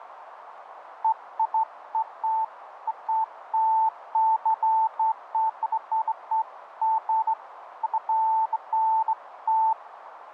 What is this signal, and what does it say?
Beeps of irregular length, with radio static and a narrow filter. There is no code.